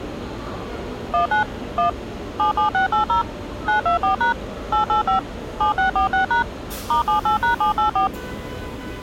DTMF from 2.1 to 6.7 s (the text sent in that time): 77680 924# 885 7646#